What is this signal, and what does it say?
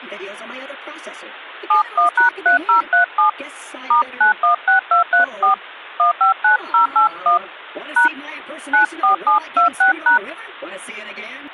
DTMF, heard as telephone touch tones, dialled by hand, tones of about 120 ms. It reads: 71#3037 *916234 159081 # 94726#